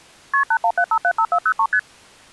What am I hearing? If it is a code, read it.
Multi-frequency trunk signalling (R1, as on North American trunks), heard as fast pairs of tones, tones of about 70 ms. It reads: KP 817575403 ST